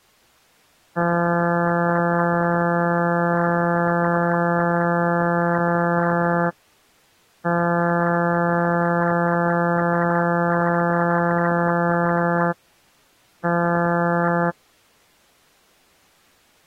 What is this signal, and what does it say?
Ship horn signal, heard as a ship's horn, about 170 Hz. 2 long, 1 short. At sea: I intend to overtake on your starboard side.